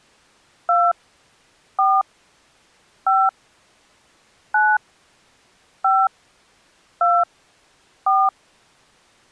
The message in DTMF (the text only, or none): 2 4 5 9 5 2 4